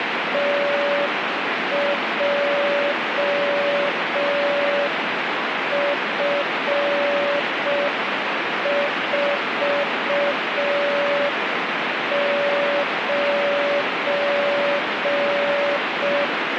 Morse code, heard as a keyed tone, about 5 wpm, 570 Hz, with heavy radio static. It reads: TJF49